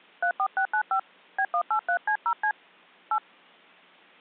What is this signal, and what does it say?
DTMF, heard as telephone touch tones, dialled by hand, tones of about 80 ms. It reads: 34695 B183C0C 8